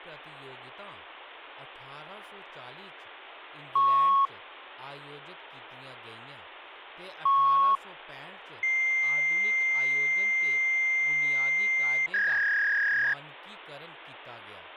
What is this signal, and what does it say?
Fax machine handshake, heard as beeps, a long tone and a warble, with phone line noise and speech in Dogri.